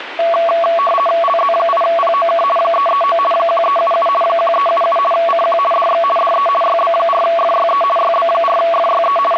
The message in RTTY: LZ8POK 339 1377 1377 CQ DX DE YB4FYE YB4FYE …

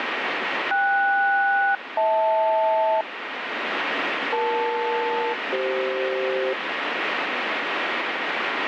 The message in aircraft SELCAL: KS-HL EL-CF

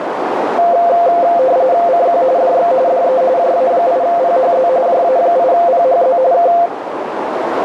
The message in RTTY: CQ DX DE JA8PHZ JA8PHZ K

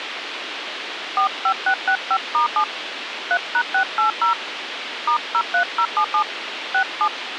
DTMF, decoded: 45665*7 3#680 *03077 67

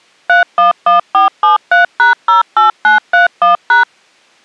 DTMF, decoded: 311473#08931#

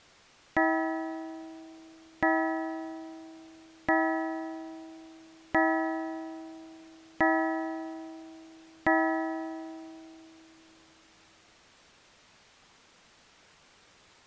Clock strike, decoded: 6

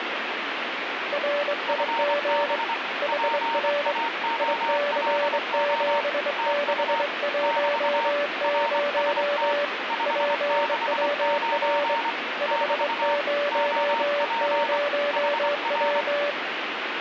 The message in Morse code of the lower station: RIG HR IC7610 PWR 500W

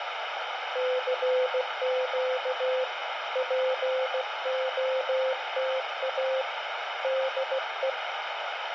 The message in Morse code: CQ POTA DE

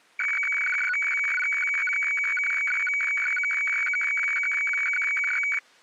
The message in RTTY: none

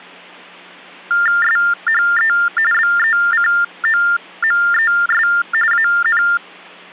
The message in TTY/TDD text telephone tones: SHE BECOMES AN

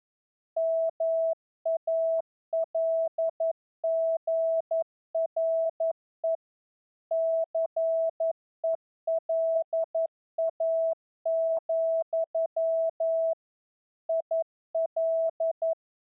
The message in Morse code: MALGRE CELA, IL

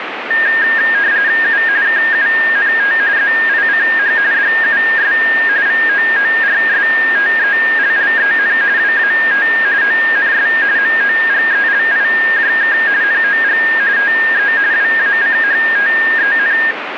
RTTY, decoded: U KUNT ZICH DUS VOORSTELLEN WAT ONS MOGELIJK NOG TE WACHTEN

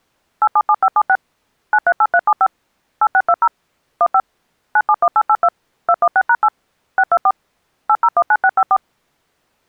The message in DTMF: 877576 938375 8620 15 971882 216#8 624 8019654

